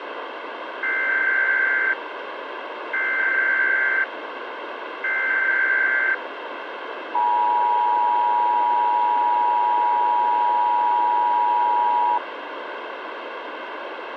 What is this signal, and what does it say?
Emergency Alert System (SAME) tones (header bursts, then the 853 and 960 Hz attention tone), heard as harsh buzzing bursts, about 520.83 baud, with radio hiss.